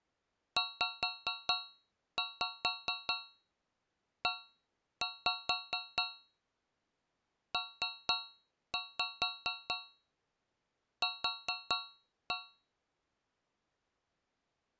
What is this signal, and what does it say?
Tap code, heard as taps on a metal pipe, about 4 knocks a second. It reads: ZEPQ